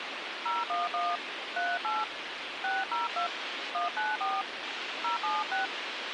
DTMF, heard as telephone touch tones, dialled by hand, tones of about 160 ms, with radio hiss. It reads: 011 38 602 194 076